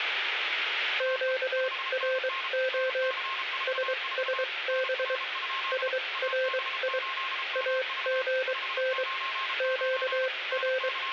Morse code, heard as a keyed tone, machine-sent, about 23 wpm, spaced as for 19 wpm, 520 Hz, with radio static, a weaker station near 1070 Hz and room echo. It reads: QRO SSB SRI AGN …